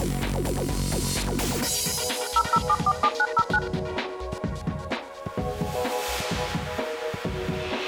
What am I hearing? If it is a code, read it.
DTMF, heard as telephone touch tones, dialled by machine, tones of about 60 ms. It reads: 00747909